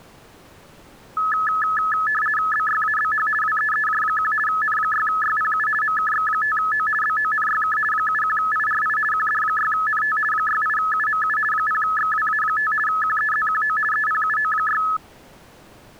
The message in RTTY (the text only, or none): BYABH WEEJ1 N6YPU MKX5O BONYK 71IRI QD6NT 68UMU 0XWA5 QEZQO EPUO6